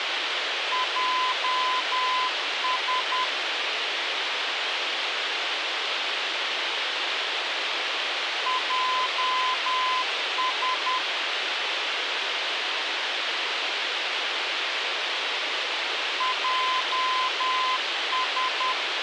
Morse code, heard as a keyed tone, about 10 wpm, 1020 Hz, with radio hiss. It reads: JS JS JS